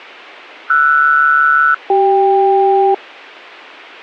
Aircraft SELCAL, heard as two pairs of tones, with a squelch burst at the end. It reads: RS-CK